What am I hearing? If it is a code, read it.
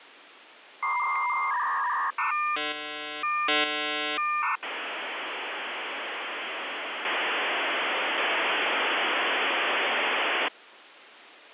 Dial-up modem handshake (V.34 or later), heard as a whistle, warbles, then hiss, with phone line noise.